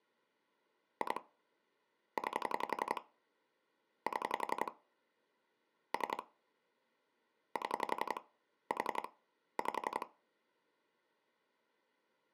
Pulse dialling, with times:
1.0-1.2 2
2.2-3.0 9
4.1-4.7 7
5.9-6.2 3
7.6-8.2 7
8.7-9.1 4
9.6-10.1 5

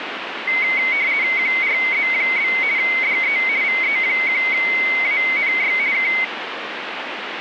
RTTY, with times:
1.4-2.5 QRZ?
2.8-3.4 DE
3.6-5.7 VE1ANY
5.9-6.1 K

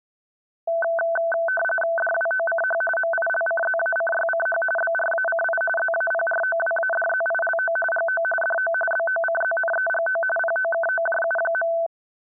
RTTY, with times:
2.0-2.8 DWOCH
3.0-4.6 MILCZACYCH
4.8-5.6 BRACI
5.8-7.8 ZAPROWADZILO
7.9-8.2 GO
8.4-8.7 DO
8.9-10.2 BOCZNEGO
10.4-11.7 POKOJU.

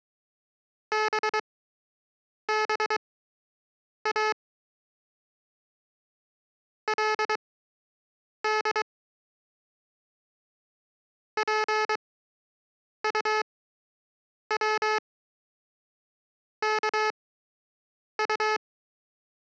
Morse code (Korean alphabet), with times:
0.9-4.3 또
6.9-8.8 그
11.4-18.6 집이

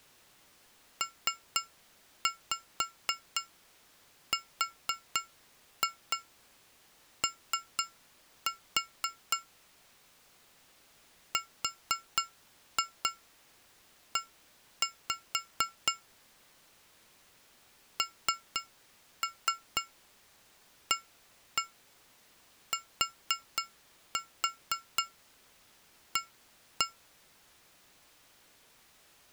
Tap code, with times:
1.0-9.4 PRO
11.3-15.9 RE
18.0-26.9 NATA

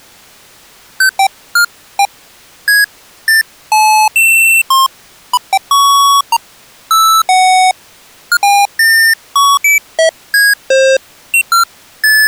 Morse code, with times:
none

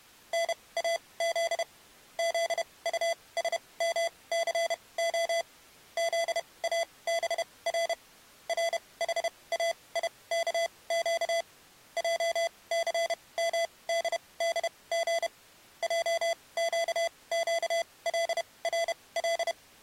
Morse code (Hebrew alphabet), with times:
0.3-1.6 נאז
2.2-5.4 זטשמסה
6.0-7.9 זאבר
8.5-11.4 רחאיכק
12.0-15.3 עסמדדג
15.8-19.5 עקקלרל

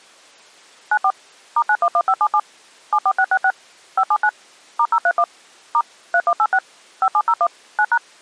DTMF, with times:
0.9-1.1 94
1.6-2.4 *911577
2.9-3.5 74666
4.0-4.3 579
4.8-5.2 *031
5.7-5.8 *
6.1-6.6 3186
7.0-7.5 5701
7.8-8.0 9#

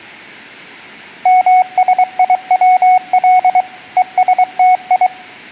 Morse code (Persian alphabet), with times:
1.3-3.6 مسیول
4.0-5.1 هستی

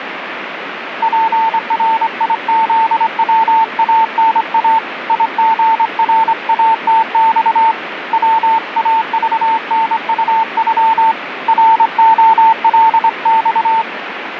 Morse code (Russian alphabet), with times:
1.0-4.8 ПРИЗВАНА
5.1-7.7 ИГРАТЬ
8.1-11.1 ВАЖНУЮ
11.5-13.8 РОЛЬ

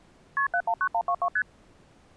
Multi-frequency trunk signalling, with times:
0.4-0.5 KP
0.5-1.3 719122
1.4-1.4 ST

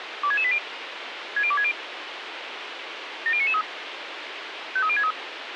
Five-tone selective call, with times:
0.2-0.6 26680
1.4-1.7 60260
3.3-3.6 70993
4.8-5.1 53063

